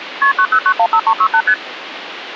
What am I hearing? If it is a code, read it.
Multi-frequency trunk signalling (R1, as on North American trunks), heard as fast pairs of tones, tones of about 70 ms, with phone line noise. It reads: KP 90915368 ST